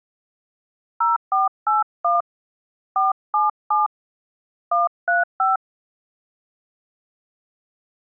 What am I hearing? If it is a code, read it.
DTMF, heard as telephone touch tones, dialled by hand, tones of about 160 ms. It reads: 0481 477 135